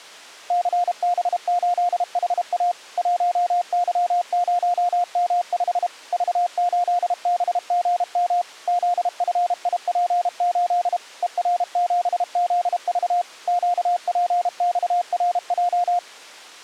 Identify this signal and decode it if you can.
Morse code, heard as a keyed tone, machine-sent, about 32 wpm, 710 Hz. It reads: CB8HA 1Y0M5 V8BGM ZFIP8 ER7ZV QPXRJ